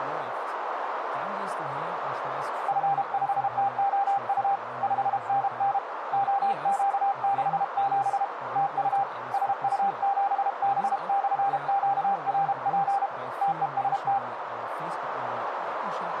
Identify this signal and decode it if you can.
Morse code, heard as a keyed tone, hand-sent with a paddle, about 32 wpm, 800 Hz, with radio static, a narrow filter and speech in German. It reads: F5TOU 5NN OQ67 TU SU7B/QRP TEST